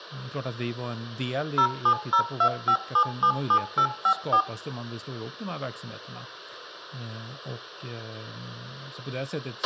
DTMF, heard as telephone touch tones, dialled by machine, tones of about 80 ms, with a squelch burst at the end, room echo and speech in Swedish. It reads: 07025777854